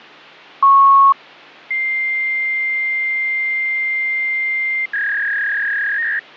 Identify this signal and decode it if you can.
Fax machine handshake, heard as a beep, a long tone and a warble, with phone line noise.